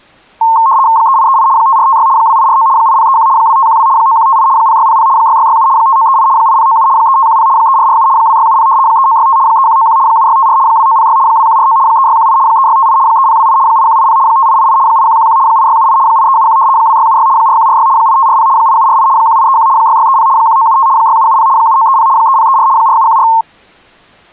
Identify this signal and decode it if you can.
RTTY (75 baud, 170 Hz shift), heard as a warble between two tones, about 990 Hz centre. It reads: 3838 5456 2849 8031 2512 9158 0600 6667 5938 8097 3510 3447 2670 3965 3191 7654 2906 2149 3618 3658 3028 8180 5888 8111 8678 8371 2676 4146 8540 8748 1831 6630 1975 6770 7930 3034 4714